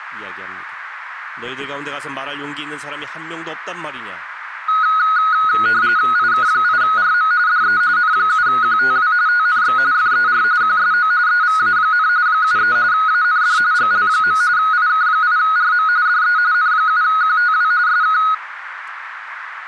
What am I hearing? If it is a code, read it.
RTTY (45.45 baud, 170 Hz shift), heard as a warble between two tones, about 1360 Hz centre, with radio static. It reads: IK8RM DE N7QTW TNX FER QSO EVA, 73 AND GL. IK8RM DE N7QTW SK